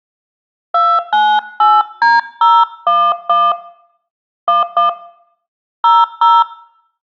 DTMF, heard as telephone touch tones, dialled by hand, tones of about 200 ms. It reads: 298D011 11 00